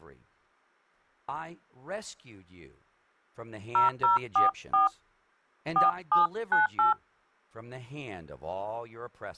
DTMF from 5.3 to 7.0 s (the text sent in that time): 4798